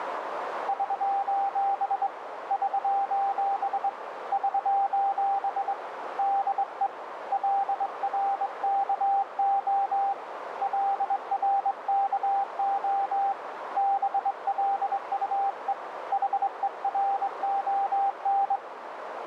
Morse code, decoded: <SOS> <SOS> <SOS> DE LRKO LRKO BLUE HERON

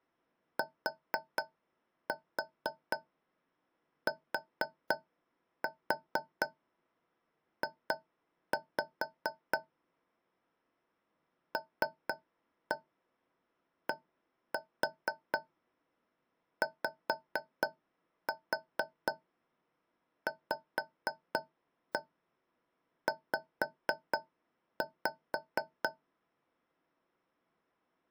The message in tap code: TTJ LDYVZ

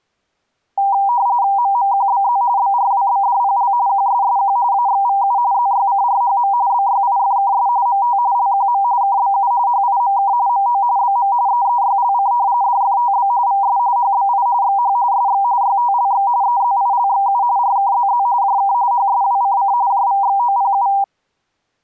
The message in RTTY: MMQBZ BRWBDPL QSSQ AXVU ZYCRHM BYIFKS MT LQM KBU HIMK MO BM EEYLC DFTB VS HBI XH SX YTLX EZILXU RKZZ JK HSWCC JVXOPU

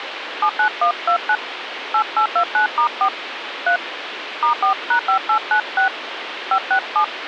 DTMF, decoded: 79129 8829*4 3 *4#5896 567

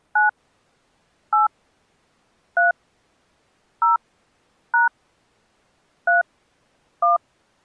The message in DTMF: 9 8 3 0 # 3 1

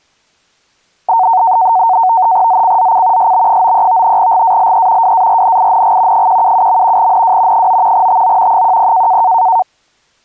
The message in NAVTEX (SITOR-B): ZCZC SB93 GALE WARNING 177. NW 9 TO 10

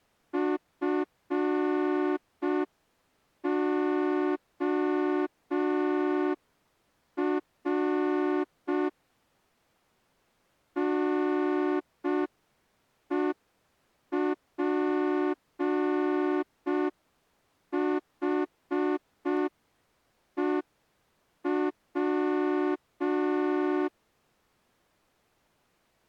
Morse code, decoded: FOR NEPHEW

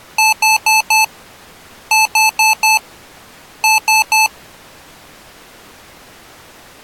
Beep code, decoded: 4-4-3

